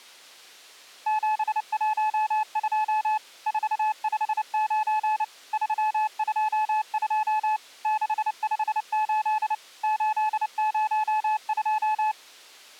Morse code, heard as a keyed tone, machine-sent, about 29 wpm, 860 Hz. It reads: 712 459 322 658 802